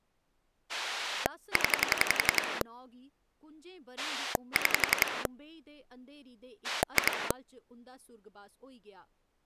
Pulse dialling, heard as a rotary dial, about 11 pulses a second, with speech in Dogri. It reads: 0 6 2